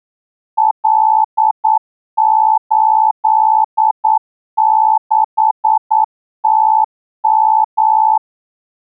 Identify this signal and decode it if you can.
Morse code, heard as a keyed tone, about 9 wpm, 870 Hz. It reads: L86TM